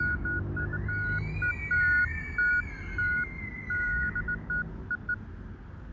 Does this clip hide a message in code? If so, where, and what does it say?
No, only beeps of irregular length, with fading and the noise of a residential street.